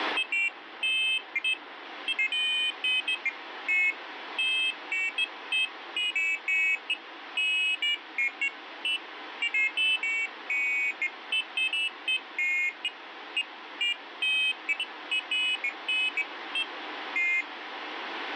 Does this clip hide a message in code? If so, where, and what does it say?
No, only pairs of high tones at irregular times, with radio static.